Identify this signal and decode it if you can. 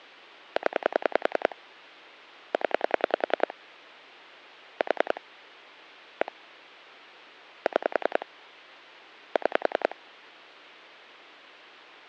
Pulse dialling, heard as clicks on a phone line, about 10 pulses a second. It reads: 0 0 4 1 6 6